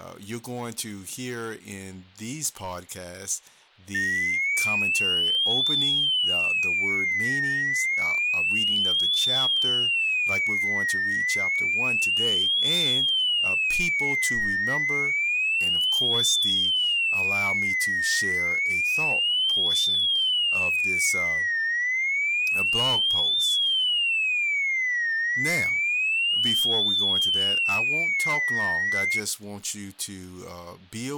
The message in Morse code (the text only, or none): none